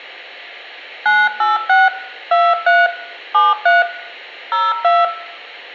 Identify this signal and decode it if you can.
DTMF, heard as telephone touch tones, dialled by hand, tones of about 200 ms, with hum and room echo. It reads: 986 23 73 02